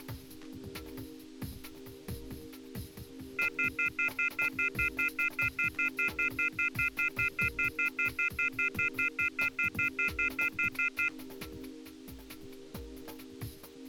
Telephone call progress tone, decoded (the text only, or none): off-hook warning tone